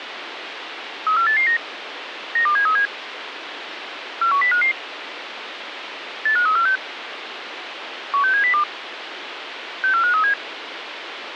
Five-tone selective call (CCIR), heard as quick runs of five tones, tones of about 100 ms, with radio hiss. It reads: 34889 92737 41055 85346 16702 64537